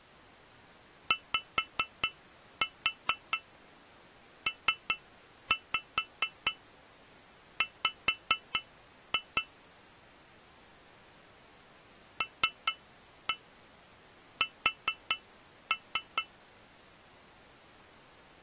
Tap code, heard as taps on glass, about 4 knocks a second. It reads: YPW LS